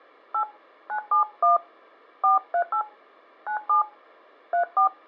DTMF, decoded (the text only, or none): 8 971 438 97 34